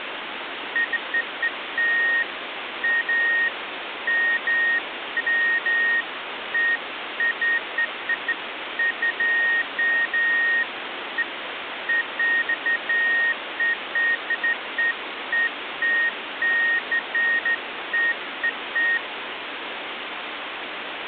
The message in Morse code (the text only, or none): none